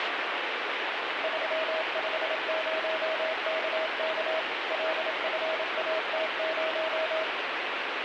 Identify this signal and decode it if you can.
Morse code, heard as a keyed tone, machine-sent, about 27 wpm, 640 Hz, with heavy radio static. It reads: 350KK LFAT0